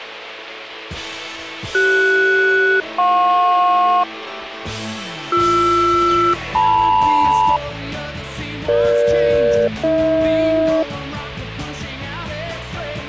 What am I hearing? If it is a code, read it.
Aircraft SELCAL, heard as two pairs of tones. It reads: CS-JP BR-LM EG-AH